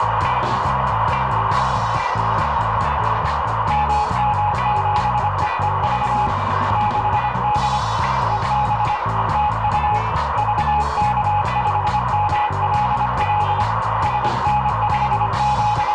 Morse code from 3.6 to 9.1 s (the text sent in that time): MM7EEV 6D EB